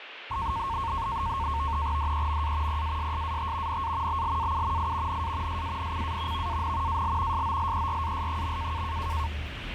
NAVTEX (SITOR-B), 100 baud, 170 Hz shift, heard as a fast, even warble, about 1000 Hz centre, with radio static and the noise inside a bus. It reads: DEMA PASSAT NA BLAU I NA SANCA VAN AL SOLERAS.